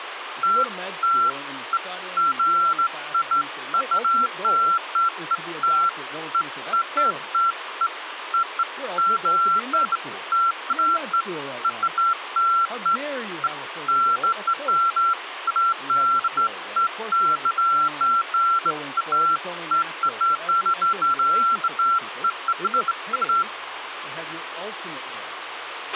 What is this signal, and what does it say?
Beeps of irregular length, with radio hiss, a squelch burst at the end and speech in English. There is no code.